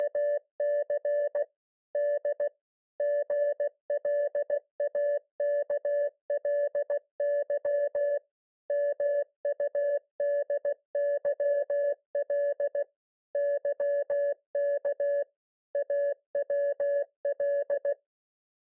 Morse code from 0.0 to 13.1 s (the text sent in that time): … D GLAKLY MUDYL